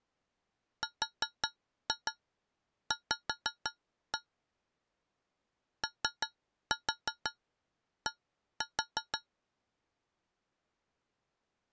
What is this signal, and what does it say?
Tap code, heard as taps on a metal pipe, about 5 knocks a second. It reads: RV OD